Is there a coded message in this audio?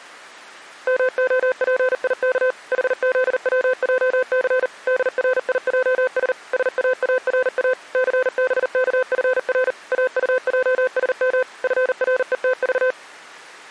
Yes: Morse code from 0.8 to 13.0 s, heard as a keyed tone, machine-sent, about 39 wpm, 510 Hz. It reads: MOPIK HZWJC DRIJS SAARA CBKFR AUJSM FRETV